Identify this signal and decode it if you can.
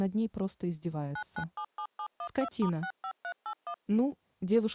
DTMF, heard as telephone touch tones, dialled by machine, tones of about 80 ms. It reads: 9977712*65381